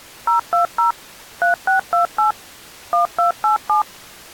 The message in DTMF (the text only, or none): 020 3628 1287